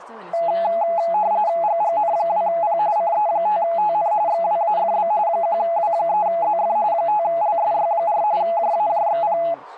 RTTY (45.45 baud, 170 Hz shift), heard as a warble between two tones, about 760 Hz centre, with speech in Spanish. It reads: GGN2P CE5TN XWAFB 1W3ZF 5LSY4 JAJXP